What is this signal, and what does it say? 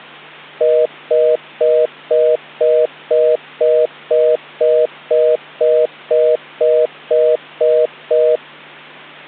Telephone call progress tone (North American plan), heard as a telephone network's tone, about 480, 620 Hz, 0.25 s on and 0.25 s off, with hum. Congestion tone.